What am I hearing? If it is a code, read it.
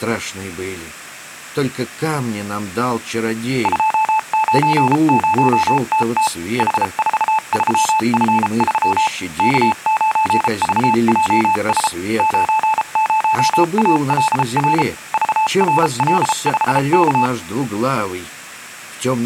Morse code, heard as a keyed tone, machine-sent, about 33 wpm, spaced as for 30 wpm, 870 Hz. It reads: 290TT H43F3 K9VJS 90ALR VRL5K